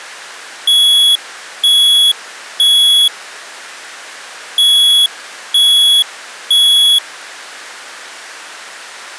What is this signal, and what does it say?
Alarm pattern, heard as an alarm's beeps, played twice, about 3350 Hz. Temporal three. Smoke or fire, evacuate.